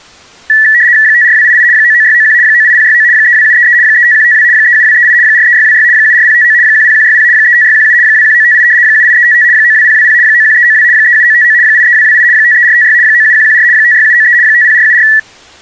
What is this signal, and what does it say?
RTTY (75 baud, 170 Hz shift), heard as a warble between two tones, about 1850 Hz centre. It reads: 54288 99691 98069 32733 35152 37238 43626 74059 10160 35617 21958 78355 92020 91392 37959 83228 53456 97114 56793 50474